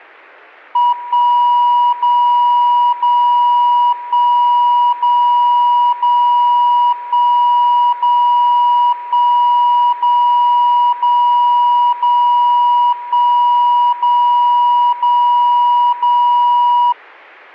Radio time signal (DCF77), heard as a tone whose level steps once a second, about 970 Hz. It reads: 1 0 0 1 0 0 1 0 1 0 0 0 1 0 0 0